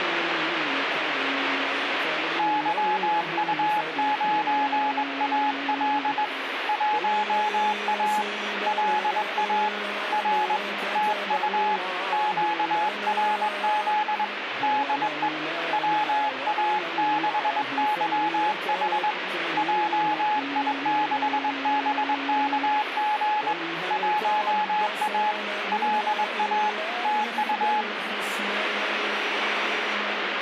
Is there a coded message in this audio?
Yes: Morse code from 2.3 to 27.9 s, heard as a keyed tone, hand-sent with a straight key, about 21 wpm, 850 Hz, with radio static. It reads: YU9AL 1A LA R TU QRZ DE WA6YH JI6BKG 1A LA TU